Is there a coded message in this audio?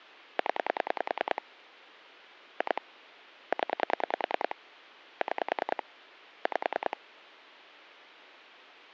Yes: pulse dialling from 0.4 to 6.9 s, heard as clicks on a phone line, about 10 pulses a second, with phone line noise. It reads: 0 2 0 6 5